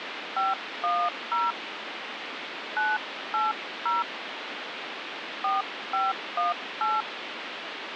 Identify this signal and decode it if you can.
DTMF, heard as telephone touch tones, dialled by hand, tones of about 200 ms, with phone line noise. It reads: 510 980 4518